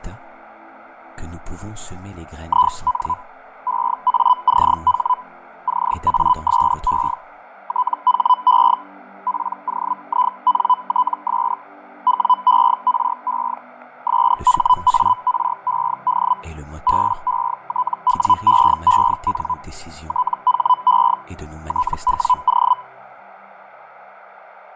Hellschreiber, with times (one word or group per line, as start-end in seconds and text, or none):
2.5-3.1 IN
3.7-5.1 EACH
5.7-7.1 CASE
7.7-8.7 THE
9.3-11.5 POINTS
12.1-13.5 WERE
14.1-16.3 SHARED
16.9-19.5 BETWEEN
20.1-21.1 THE
21.7-22.7 TWO